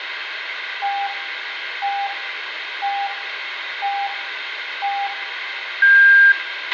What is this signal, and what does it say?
Radio time signal (five pips and a higher one, as on Chinese radio), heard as pips, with radio hiss, a squelch burst at the end and room echo.